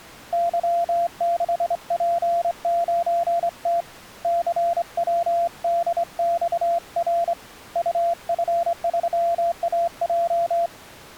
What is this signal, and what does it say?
Morse code, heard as a keyed tone, hand-sent with a straight key, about 25 wpm, 680 Hz. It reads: Y6P9T CWDXR UF3AJ